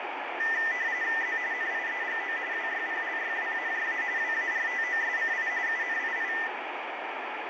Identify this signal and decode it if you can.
RTTY (45.45 baud, 170 Hz shift), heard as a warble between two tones, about 1900 Hz centre, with radio static. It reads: Z NIEGO WYPLYWAJA WARTOSCI UNII